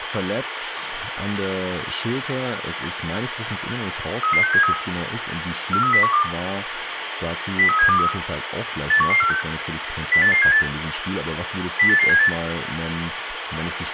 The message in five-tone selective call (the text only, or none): 33673 43012 03723 81146 08878 08878